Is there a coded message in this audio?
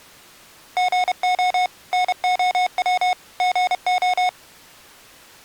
Yes: Morse code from 0.7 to 4.4 s, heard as electronic beeps, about 31 wpm, 730 Hz. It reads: GO NOW GO